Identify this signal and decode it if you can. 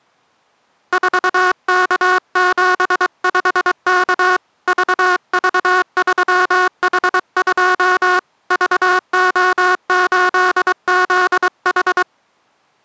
Morse code, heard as a buzzer, hand-sent with a paddle, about 23 wpm. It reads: 4K75K VV3H2 VO8ZH